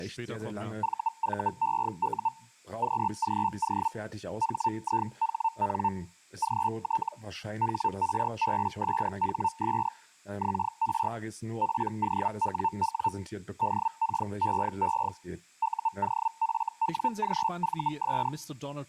Hellschreiber (Feld-Hell, 122.5 baud), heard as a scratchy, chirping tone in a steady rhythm, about 900 Hz, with speech in German. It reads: VVEU QGO HIHN GT HRBSHS XR POWW DKEE UOFWGVS